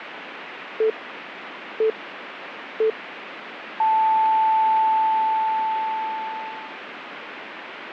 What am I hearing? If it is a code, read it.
Radio time signal (three low pips and a long one an octave up, as on NHK), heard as pips, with radio static.